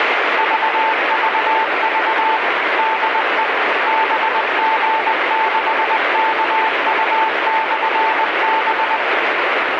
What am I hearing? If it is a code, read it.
Morse code, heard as a keyed tone, machine-sent, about 20 wpm, 890 Hz, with heavy radio static. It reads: VVV DE BG6KU/B